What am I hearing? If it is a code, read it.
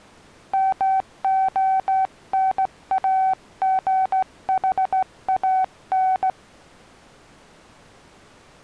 Morse code, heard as a keyed tone, hand-sent with a straight key, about 16 wpm, 760 Hz. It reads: MONAGHAN